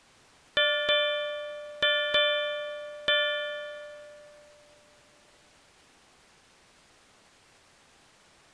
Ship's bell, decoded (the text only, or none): 5